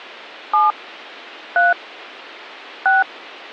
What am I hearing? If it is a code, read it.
DTMF, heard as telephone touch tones, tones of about 170 ms. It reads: 7 3 6